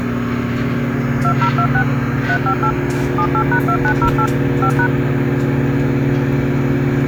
DTMF, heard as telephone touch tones, dialled by machine, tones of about 80 ms, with kitchen noise. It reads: 2026 358 78#2908 5#